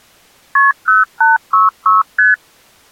Multi-frequency trunk signalling (R1, as on North American trunks), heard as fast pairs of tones, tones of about 160 ms. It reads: KP 0866 ST